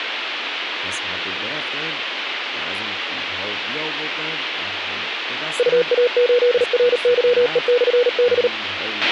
Morse code, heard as a keyed tone, machine-sent, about 38 wpm, 490 Hz, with radio hiss, a squelch burst at the end and speech in Persian. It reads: UA8RYE/B